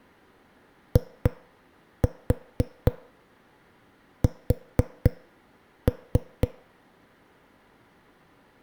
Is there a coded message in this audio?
Yes: tap code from 1.0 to 6.5 s, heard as knocks on a wall, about 4 knocks a second. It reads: IS